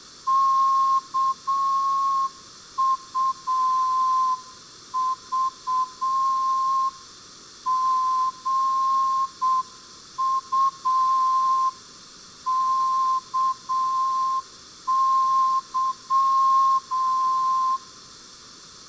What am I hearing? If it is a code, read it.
Morse code (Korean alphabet), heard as a whistle, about 7 wpm, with room echo. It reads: 일시에